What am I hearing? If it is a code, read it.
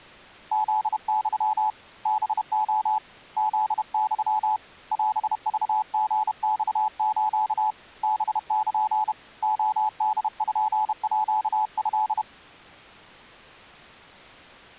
Morse code (Japanese Wabun code), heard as a keyed tone, hand-sent with a paddle, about 31 wpm, 860 Hz. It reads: フユ ハレ フユ オクリマス ハル レポート